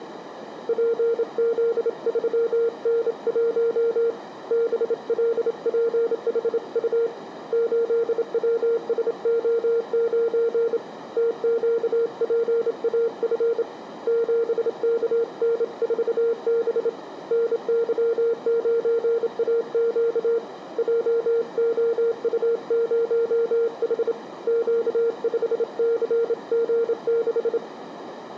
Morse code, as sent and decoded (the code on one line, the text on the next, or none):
.--. --.. ...-- -. .---- / -... .-.. .--. .... ..- / ---.. .-- ... --- ----. / - --.- .--. .- ..-. / --... -.- -. ....- -... / -. -.-- ----. .- --.- / .--- --- ..- ----- .... / --.- ..... -.-. --. -....
PZ3N1 BLPHU 8WSO9 TQPAF 7KN4B NY9AQ JOU0H Q5CG6